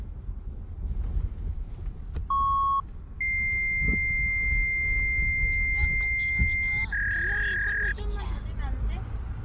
Fax machine handshake, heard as a beep, a long tone and a warble, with the noise inside a car.